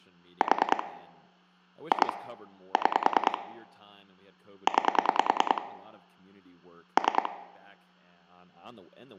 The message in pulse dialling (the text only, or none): 4 2 6 9 3